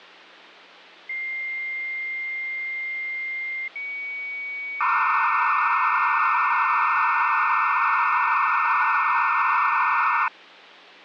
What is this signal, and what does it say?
Dial-up modem handshake (low-speed, two carriers), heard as two whistles, then hiss.